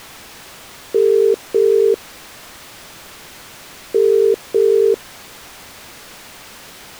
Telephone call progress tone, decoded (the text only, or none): ringback tone